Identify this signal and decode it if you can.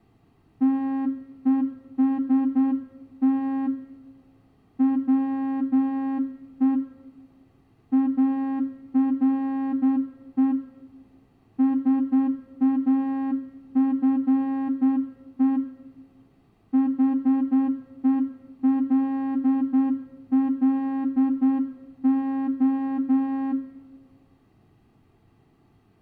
Morse code, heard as a horn, hand-sent with a straight key, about 9 wpm, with room echo. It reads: TEST WE ARE SAFE HELLO